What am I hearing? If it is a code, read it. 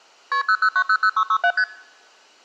Multi-frequency trunk signalling (R1, as on North American trunks), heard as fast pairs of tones, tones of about 70 ms. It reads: KP 00900667 ST